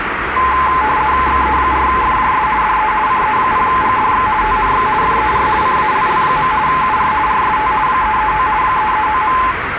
RTTY (50 baud, 170 Hz shift), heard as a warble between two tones, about 950 Hz centre, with radio static and street noise. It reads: XE4FJS DE CE0GDX TNX FER CALL. UR RST 339 339.